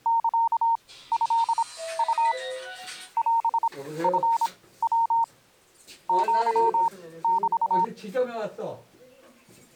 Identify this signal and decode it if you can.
Morse code (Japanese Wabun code), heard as a keyed tone, machine-sent, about 26 wpm, spaced as for 16 wpm, 920 Hz, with the noise inside a lift. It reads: サトウ オチヤ アメ